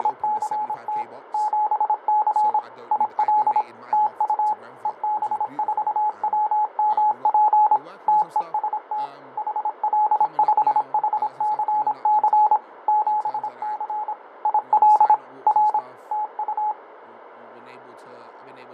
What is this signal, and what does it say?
Morse code, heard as a keyed tone, machine-sent, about 26 wpm, 850 Hz, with radio static, fading and speech in English. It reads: … 7C IL TU EB4WMP TEST HL5HCC 7C IL R TU